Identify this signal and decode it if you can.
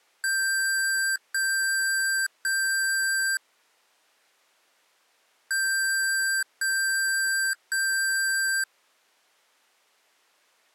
Beep code, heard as beeps from a small speaker, played twice, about 1550 Hz. 3 long. In IBM BIOS tables: keyboard card error.